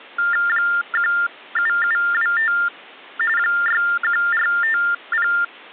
TTY/TDD text telephone tones (45.45 baud Baudot), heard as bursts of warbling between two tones, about 400 Hz shift, 1600 Hz centre. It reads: 17725 61450